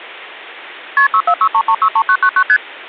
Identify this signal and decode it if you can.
Multi-frequency trunk signalling (R1, as on North American trunks), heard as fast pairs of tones, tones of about 70 ms. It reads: KP 6463363999 ST